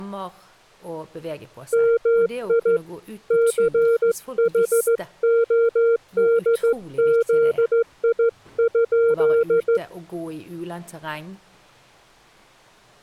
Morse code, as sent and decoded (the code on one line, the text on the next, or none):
-- .. / -.-. .... --- -.. --.. .. ..--..
MI CHODZI?